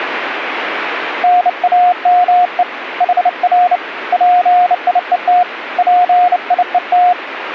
Morse code, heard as a keyed tone, hand-sent with a bug key, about 29 wpm, 720 Hz, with radio static. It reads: NAME HR PIET PIET